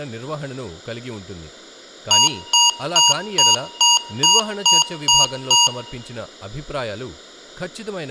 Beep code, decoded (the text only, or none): 9 short